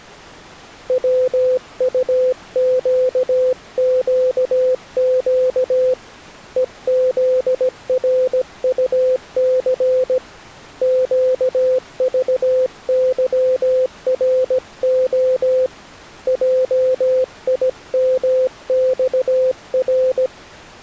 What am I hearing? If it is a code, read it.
Morse code, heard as a keyed tone, hand-sent with a paddle, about 17 wpm, 510 Hz. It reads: WUQQQ EZRUC QVYRO JIMXR